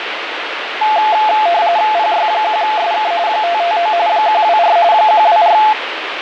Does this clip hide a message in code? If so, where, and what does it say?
Yes: RTTY (45.45 baud, 170 Hz shift) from 0.8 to 5.7 s, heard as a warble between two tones, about 780 Hz centre, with radio static. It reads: PY1SK 559 124 124